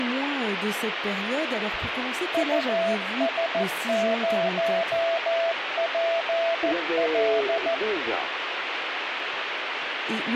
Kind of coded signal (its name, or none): Morse code